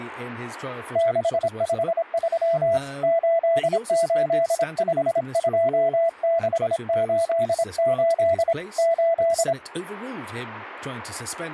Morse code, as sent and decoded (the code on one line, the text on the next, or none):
-.... ..... ...-- / ---.. ---.. ..... ..--- -.... ---.. ---.. / ---..
653 8852688 8